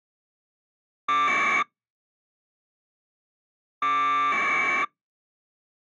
Packet radio (AX.25, as in APRS), 1200 baud, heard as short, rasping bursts.